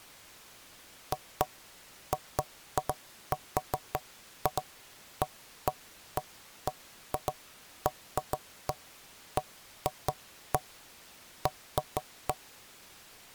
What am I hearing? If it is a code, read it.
Irregular knocks on wood. There is no code.